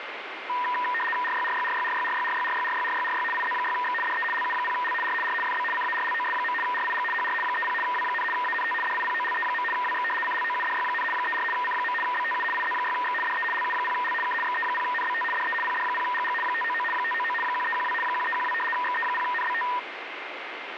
RTTY (75 baud, 850 Hz shift), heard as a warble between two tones, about 1410 Hz centre, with radio static. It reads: RYRYRYRYRYRYRYRYRYRY IZ6X DE LU0L R R FB CARLOS. RIG HR 30 W, ANT DIPOLE. WX CLOUDY, 34 C. BTU IZ6X DE LU0L K XE0NBT DE PD0GG 599 599 1312 1312 XE0NBT